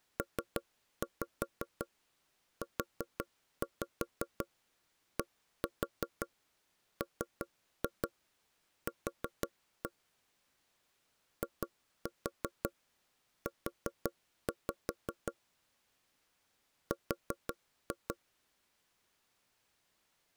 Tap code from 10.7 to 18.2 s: IU R

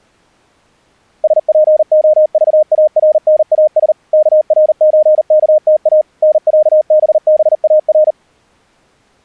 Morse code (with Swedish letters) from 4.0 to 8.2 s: KRÖKTA NÄBBAR

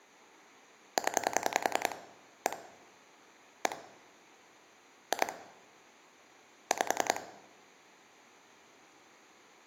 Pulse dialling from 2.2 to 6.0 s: 1 1 2

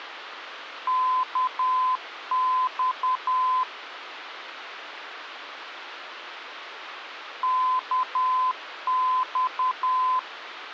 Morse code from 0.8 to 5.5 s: KX

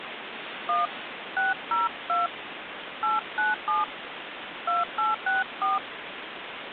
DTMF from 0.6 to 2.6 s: 1 602

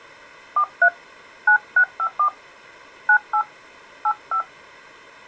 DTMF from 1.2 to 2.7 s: 9654

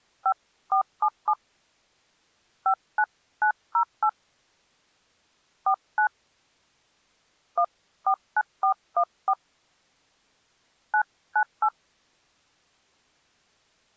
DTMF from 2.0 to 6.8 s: 59908 49

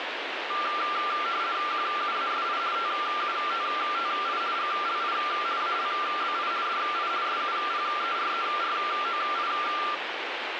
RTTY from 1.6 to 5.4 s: QUASI TUTTI GLI

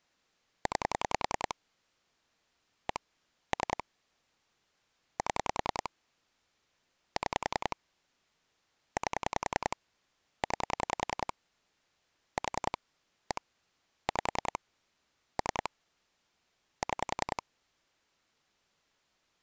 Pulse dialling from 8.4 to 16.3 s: 8 9 4 1 5 3

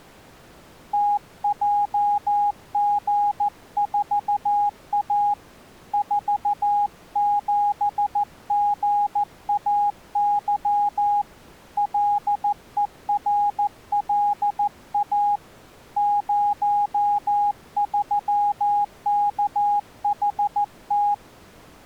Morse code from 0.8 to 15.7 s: TJG4A 47GAY LERLA

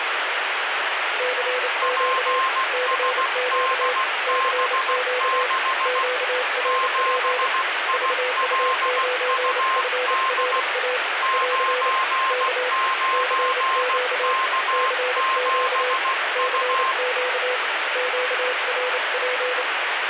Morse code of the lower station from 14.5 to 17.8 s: CQ CQ

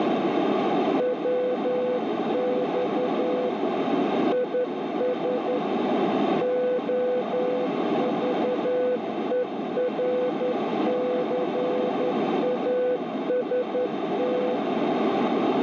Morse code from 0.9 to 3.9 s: WX

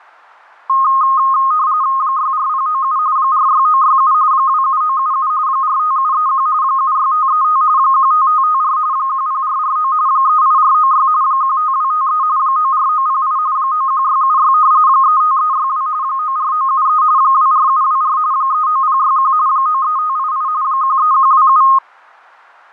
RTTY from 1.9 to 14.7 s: 64097 46967 27977 45731 76535 15554 10449 38496 15253 94908 91676

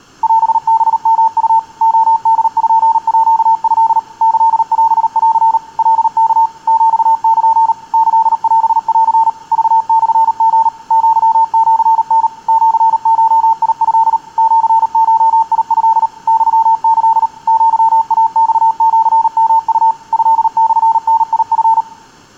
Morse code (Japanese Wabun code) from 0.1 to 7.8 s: オハヨウ レポート キオン カワ ヒル

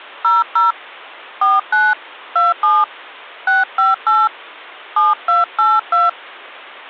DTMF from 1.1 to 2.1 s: 49

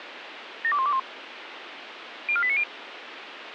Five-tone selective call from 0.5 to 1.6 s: 72121

